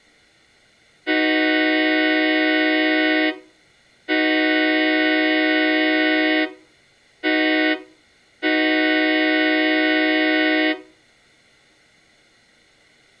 Train horn signal, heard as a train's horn, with room echo. 2 long, 1 short, 1 long. On North American railways: approaching a public crossing.